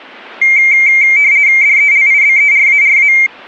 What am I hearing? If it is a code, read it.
RTTY (50 baud, 170 Hz shift), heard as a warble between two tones, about 2200 Hz centre. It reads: DELIBERARA